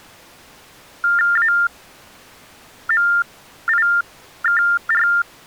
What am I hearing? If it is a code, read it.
TTY/TDD text telephone tones (45.45 baud Baudot), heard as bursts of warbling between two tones, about 400 Hz shift, 1600 Hz centre. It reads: AMIKR